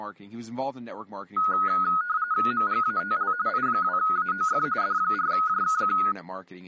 RTTY (45.45 baud, 170 Hz shift), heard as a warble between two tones, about 1360 Hz centre, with speech in English. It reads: MGATL I2AOF D4JKQ